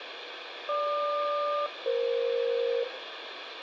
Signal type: aircraft SELCAL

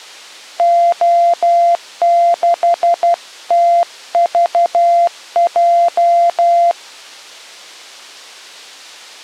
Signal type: Morse code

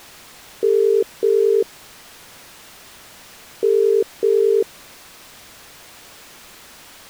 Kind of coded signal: telephone call progress tone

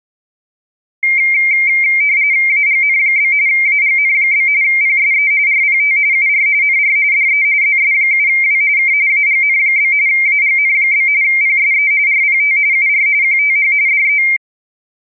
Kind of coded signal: RTTY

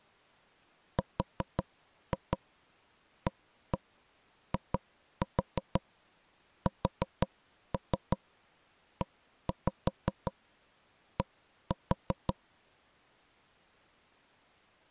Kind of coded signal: tap code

